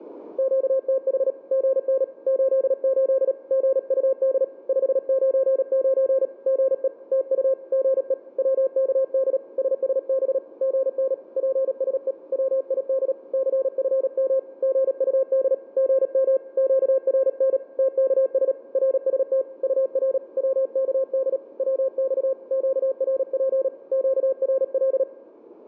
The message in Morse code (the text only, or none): QTH GN 88 GUD 599 GE TU GE WKD SSB GN PSE WID CFM GUD GM QRN TKS RST UR WKD WX QRP QRL